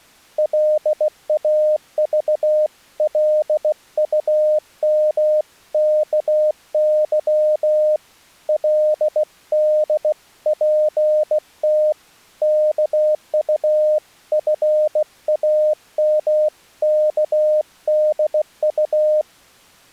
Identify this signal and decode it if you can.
Morse code (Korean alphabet), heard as a keyed tone, hand-sent with a bug key, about 16 wpm, 610 Hz. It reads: 골김에 그저 이놈의